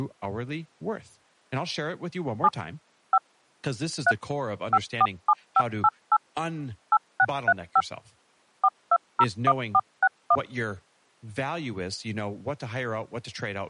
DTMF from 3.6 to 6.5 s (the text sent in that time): 3 547588